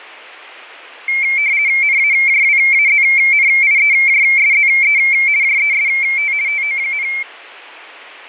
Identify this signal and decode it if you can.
RTTY (50 baud, 170 Hz shift), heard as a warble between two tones, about 2250 Hz centre, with radio static and fading. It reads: NAJWAZNIEJSZE JEST TO,